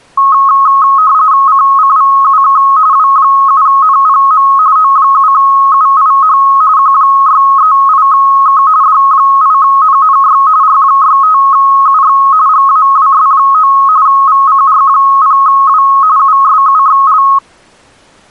RTTY (45.45 baud, 170 Hz shift), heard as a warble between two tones, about 1180 Hz centre. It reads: CCVUK W7NPM O7UIH Q638K D8NNY R65UX GAWS9 VCR0W USUXL